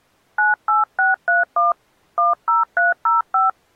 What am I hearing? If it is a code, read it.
DTMF, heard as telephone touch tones, dialled by hand, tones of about 160 ms. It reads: 98631 10305